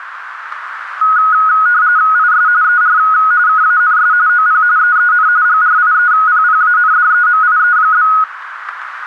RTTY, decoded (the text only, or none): IS ER KANS OP EEN GRIEPPANDEMIE?